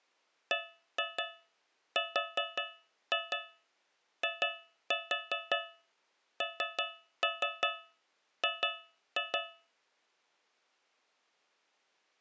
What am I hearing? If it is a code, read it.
Tap code, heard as taps on a metal pipe, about 5 knocks a second. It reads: BRING